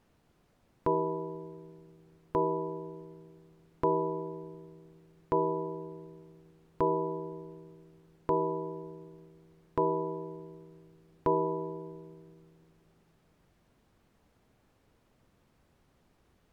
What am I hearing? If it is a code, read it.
Clock strike, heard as a bell. 8. Eight o'clock.